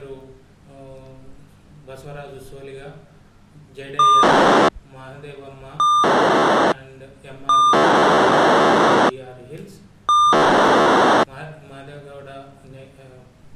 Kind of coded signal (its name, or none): POCSAG pager data